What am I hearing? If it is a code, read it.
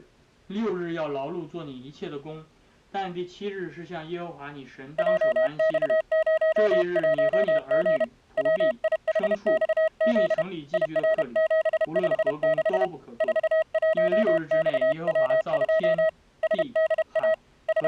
Morse code, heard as a keyed tone, hand-sent with a paddle, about 31 wpm, 640 Hz. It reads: JX01G WIHXZ IR756 41XW2 SDA …